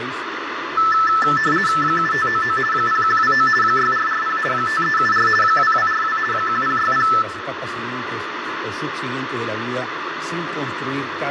RTTY (50 baud, 450 Hz shift), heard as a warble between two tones, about 1550 Hz centre, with radio static and room echo. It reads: 7599 0129 6440 5374 2242 1060